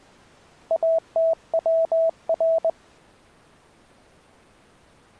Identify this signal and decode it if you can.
Morse code (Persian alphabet), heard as a keyed tone, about 20 wpm, 650 Hz. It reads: اتور